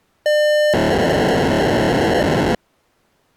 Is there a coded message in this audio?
Yes: POCSAG pager data (1200 baud) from 0.3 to 2.6 s, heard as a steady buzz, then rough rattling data.